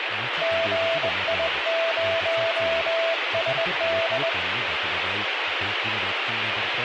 Morse code, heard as a keyed tone, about 20 wpm, 660 Hz, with radio static and speech in Kashmiri. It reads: GI0SD